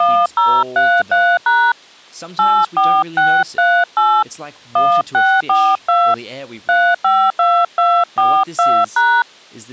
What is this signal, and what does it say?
DTMF, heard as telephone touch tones, dialled by hand, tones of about 260 ms, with speech in English. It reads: 1033# 84638 1642 352242#